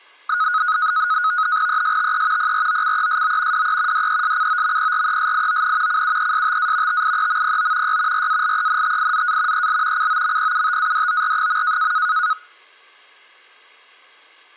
NAVTEX (SITOR-B), 100 baud, 170 Hz shift, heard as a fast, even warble, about 1360 Hz centre. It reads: ESTE PROCESO DE DESCOMPRESION CUESTA TIEMPO Y RALENTIZA EL COMPUTADOR.